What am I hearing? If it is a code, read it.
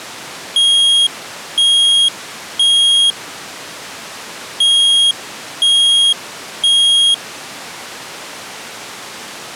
Alarm pattern, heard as an alarm's beeps, played twice, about 3250 Hz. Temporal three. Smoke or fire, evacuate.